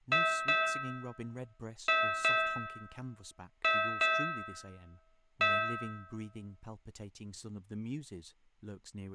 Ship's bell, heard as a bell, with room echo and speech in English. 7. Seven half-hours of the watch have passed.